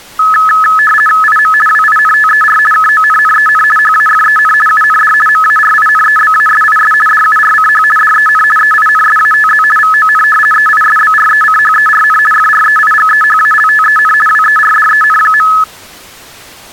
RTTY (50 baud, 450 Hz shift), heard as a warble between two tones, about 1500 Hz centre. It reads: IM WINTER KONNEN HAFEN UND MARINEBASIS DURCH DEN EINSATZ VON EISBRECHERN FREIGEHALTEN WERDEN.